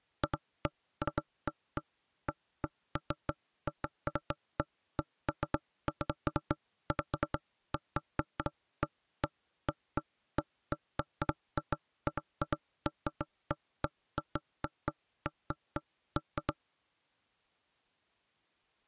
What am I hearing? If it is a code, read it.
Irregular knocks on wood. There is no code.